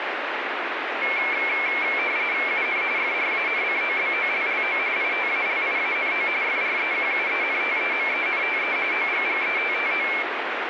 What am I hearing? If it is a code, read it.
RTTY (45.45 baud, 170 Hz shift), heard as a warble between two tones, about 2250 Hz centre, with radio static. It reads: UN FRANCOBOLLO ITALIANO FREQUENTEMENTE OGGETTO